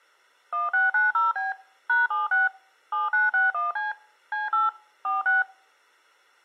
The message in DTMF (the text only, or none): 1690B #76 7961C C8 46